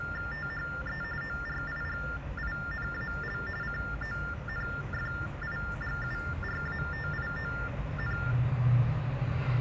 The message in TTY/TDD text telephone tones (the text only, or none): THE ORIGINAL CONFIGURATION